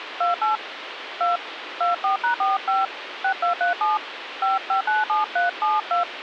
DTMF, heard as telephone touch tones, dialled by hand, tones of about 130 ms, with phone line noise. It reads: 28 2 24#45 6237 5597372